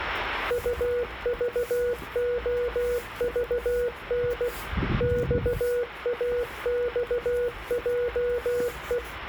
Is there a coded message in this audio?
Yes: Morse code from 0.4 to 9.0 s, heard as a keyed tone, machine-sent, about 16 wpm, 490 Hz, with the noise of a residential street. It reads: UVOVN XAXJE